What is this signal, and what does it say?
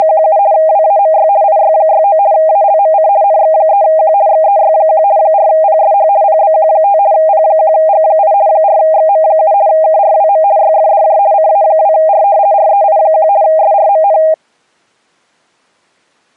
RTTY (50 baud, 170 Hz shift), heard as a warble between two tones, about 720 Hz centre. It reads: … WAMY IY69 ALMC NX3Q XEY1 4PSH PBQ5 P1G8 4XM7 KRWM YFDJ CA2R REI1 SRMN